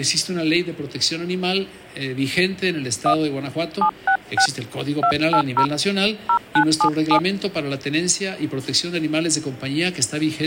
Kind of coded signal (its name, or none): DTMF